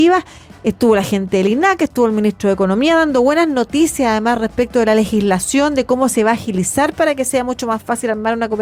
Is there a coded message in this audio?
No.